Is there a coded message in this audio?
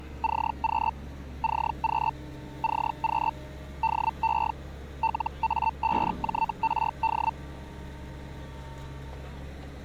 Yes: Hellschreiber (Feld-Hell, 122.5 baud) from 0.2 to 7.3 s, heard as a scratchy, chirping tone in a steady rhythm, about 900 Hz, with street noise. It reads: CQ CQ CQ DE LA5JRD